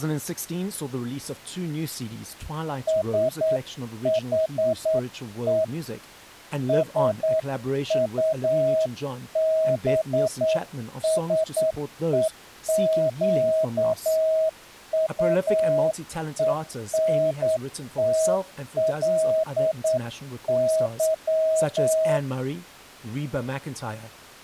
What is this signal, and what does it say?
Morse code, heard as a keyed tone, hand-sent with a straight key, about 9 wpm, 640 Hz. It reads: SHE SUBSEQUENTLY